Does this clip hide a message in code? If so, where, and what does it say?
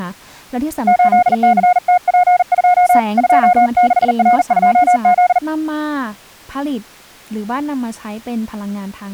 Yes: Morse code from 0.8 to 5.4 s, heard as a keyed tone, hand-sent with a bug key, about 40 wpm, 720 Hz, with speech in Thai. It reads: 8CTP2 26R2Z